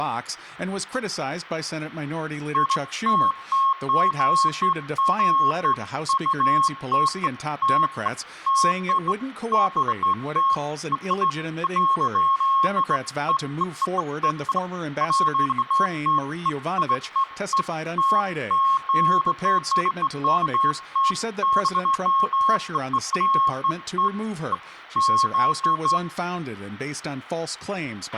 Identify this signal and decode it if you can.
Beeps of irregular length, with a squelch burst at the end and speech in English. There is no code.